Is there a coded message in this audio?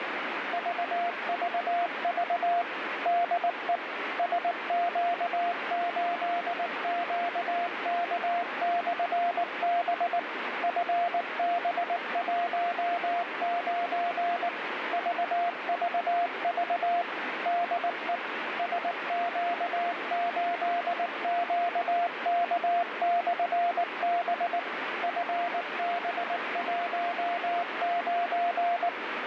Yes: Morse code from 0.5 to 28.9 s, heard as a keyed tone, machine-sent, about 19 wpm, 700 Hz, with radio static. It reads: VVV DE SQ8QK/B FB19 VVV DE SQ8QK/B FB19